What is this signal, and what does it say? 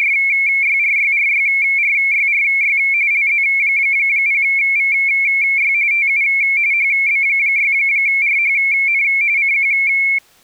RTTY (45.45 baud, 170 Hz shift), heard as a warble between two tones, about 2250 Hz centre. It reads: … LZ0VY TU HB6RHN CQ